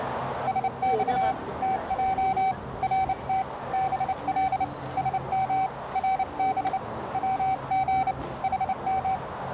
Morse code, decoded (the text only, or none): SX TJ RT BL SM RB WG HM